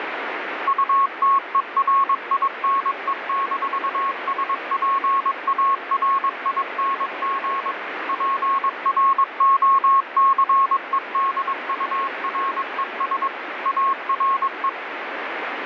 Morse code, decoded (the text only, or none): UTERINE-SPARING PROCEDURES ARE